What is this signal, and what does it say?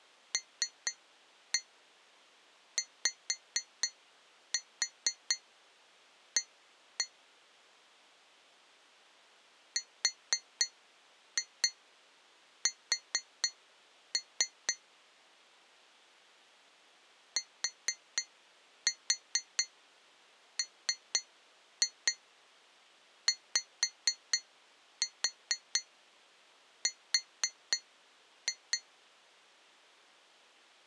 Tap code, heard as taps on glass, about 4 knocks a second. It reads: LYA RS TMYR